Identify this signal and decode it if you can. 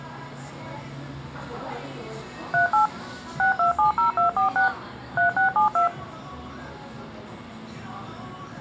DTMF, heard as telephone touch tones, dialled by machine, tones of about 120 ms, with the noise of a cafe. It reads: 38 6270246 3672